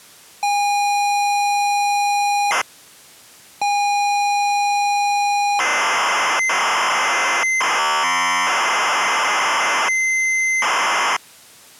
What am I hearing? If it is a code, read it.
ZX Spectrum tape loading, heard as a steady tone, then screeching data.